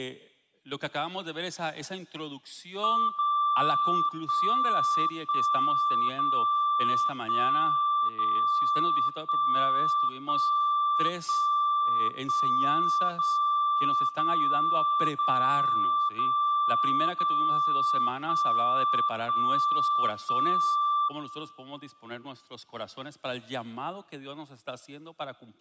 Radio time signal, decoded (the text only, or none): 0 1 1 0 1 0 1 1 1 1 0 0 0 0 0 1 1 1